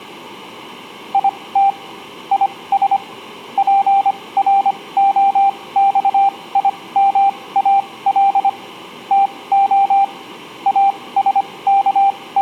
Morse code, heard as a keyed tone, machine-sent, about 25 wpm, spaced as for 19 wpm, 790 Hz. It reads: IT IS PROXIMAL TO …